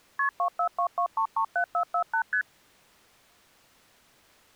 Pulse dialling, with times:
none

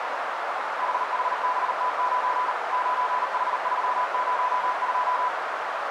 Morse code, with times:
0.8-2.5 HHBT9
2.7-5.3 9H302

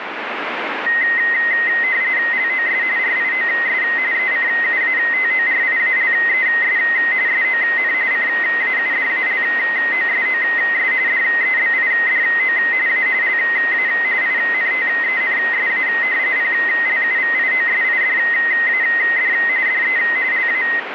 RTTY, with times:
2.3-2.8 LOS
3.0-3.8 RIOS
4.1-6.8 ECUATORIALES
7.3-7.9 SON
8.1-10.9 CAUDALOSOS
11.1-12.6 DEBIDO
12.9-13.1 A
13.2-13.9 LA
14.2-15.9 INTENSA
16.4-19.3 PLUVIOSIDAD
19.7-20.0 DE
20.3-20.6 LA

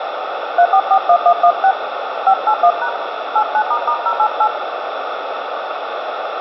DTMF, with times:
0.6-1.7 3441116
2.3-2.9 581#
3.4-4.5 89**088

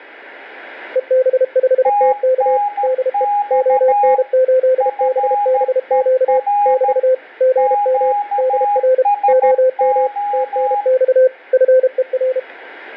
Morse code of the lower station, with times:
1.0-2.6 EB5TK
2.8-3.2 DE
3.5-6.4 ON8BBQ
6.7-7.1 <BT>
7.4-8.1 GM
8.4-9.0 DR
9.3-10.1 OM
10.3-11.3 TNX
11.5-12.4 FER

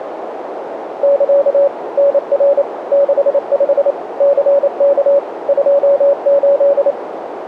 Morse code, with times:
1.0-1.7 <KA>
2.0-2.6 NR
2.9-3.9 65
4.2-5.2 CK
5.5-6.9 28

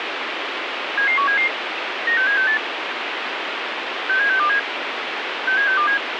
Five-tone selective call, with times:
1.0-1.5 77177
2.1-2.6 96768
4.1-4.6 67627
5.5-6.0 67627

